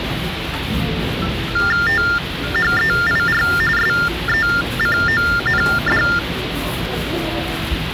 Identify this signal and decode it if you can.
TTY/TDD text telephone tones (45.45 baud Baudot), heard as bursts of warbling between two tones, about 400 Hz shift, 1600 Hz centre, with phone line noise and the noise of a crowd indoors. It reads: THEIR SECOND